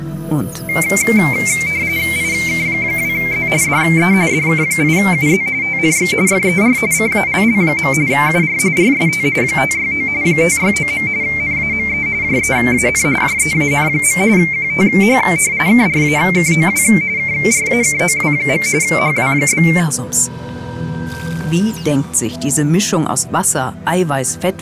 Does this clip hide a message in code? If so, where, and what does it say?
Yes: RTTY (45.45 baud, 170 Hz shift) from 0.7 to 19.8 s, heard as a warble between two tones, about 2200 Hz centre. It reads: IK2Z DE DK8UZ TNX FER CALL. UR RST 569 569. NAME JEAN JEAN. QTH KRAKOW KRAKOW. HW?